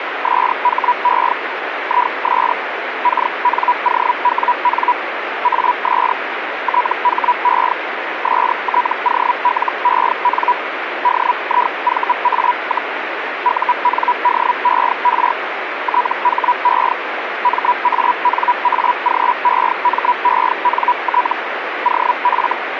Hellschreiber (Feld-Hell, 122.5 baud), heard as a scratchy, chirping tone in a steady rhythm, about 980 Hz, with radio static. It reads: SHE IS KNOWN AS THE STOLEN DIVA, UNDER THE MANAGEMENT OF